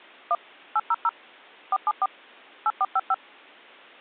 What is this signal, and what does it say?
DTMF, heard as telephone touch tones, dialled by machine, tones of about 40 ms. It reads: 1 800 474 8455